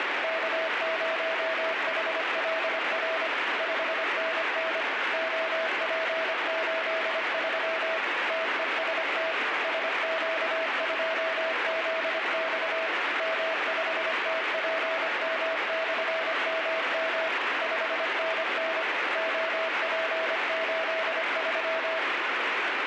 Morse code, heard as a keyed tone, machine-sent, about 25 wpm, 650 Hz, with heavy radio static. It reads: K0HLR 5NN OP83 TEST SQ2ZX M5TPM/MM 5NN OP83